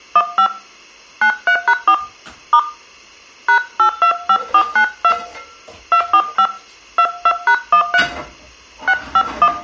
DTMF, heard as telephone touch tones, dialled by hand, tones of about 70 ms, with room echo and kitchen noise. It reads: 15 93#4 * #825492 245 22#13 651